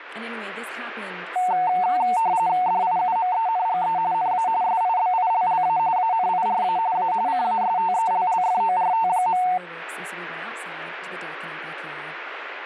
RTTY (45.45 baud, 170 Hz shift), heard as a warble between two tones, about 820 Hz centre, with speech in English. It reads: DIUMENGE NA SIBILLA ANIRA A CASTELLFORT.